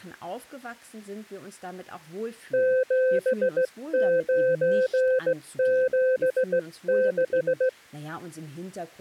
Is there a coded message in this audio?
Yes: Morse code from 2.5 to 7.8 s, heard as a keyed tone, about 16 wpm, 520 Hz, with speech in German. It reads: 7976